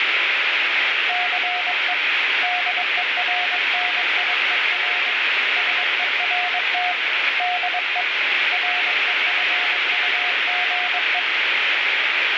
Morse code, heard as a keyed tone, hand-sent with a paddle, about 22 wpm, 720 Hz, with heavy radio static. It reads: CE DERNIER SERT DE REFUGE